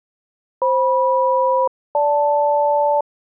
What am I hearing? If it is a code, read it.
Aircraft SELCAL, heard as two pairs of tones. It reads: FM-GL